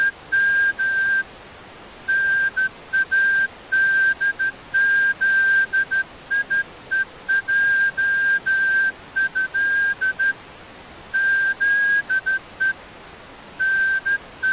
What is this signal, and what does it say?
Morse code (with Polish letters), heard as a whistle, hand-sent with a straight key, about 13 wpm. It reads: … NADZIEJĘ ZE …